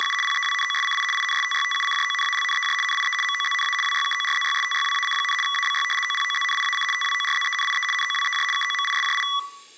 RTTY (75 baud, 850 Hz shift), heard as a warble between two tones, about 1550 Hz centre. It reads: … PEWNOSCI INSTYTUCJONALNEJ NIE MOZNA WYKORZYSTYWAC, ABY OPOZNIAC TWORZENIE NOWEJ KOMISJI